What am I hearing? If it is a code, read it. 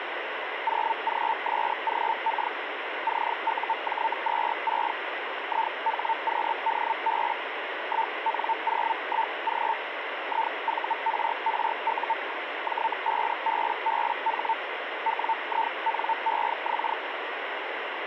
Hellschreiber (Feld-Hell, 122.5 baud), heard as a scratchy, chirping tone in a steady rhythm, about 900 Hz, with radio static. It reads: 0GSGK CUJ26 IHQDB 1N01G IVRRU J5BBH WINEX